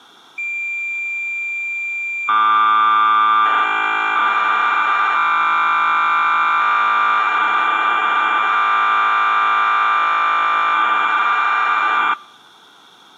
Cassette data (Kansas City type), 1200 baud, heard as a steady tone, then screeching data.